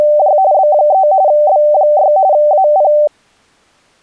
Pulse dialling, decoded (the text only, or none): none